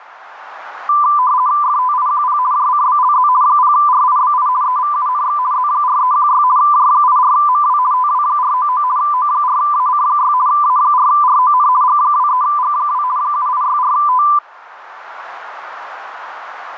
RTTY (50 baud, 170 Hz shift), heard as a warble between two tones, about 1090 Hz centre, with radio static. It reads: FTIQP JCBLZ 0RIBI EVUNX Z4316 J84MW TW499 O4AC6 A4RON G23G2 7864T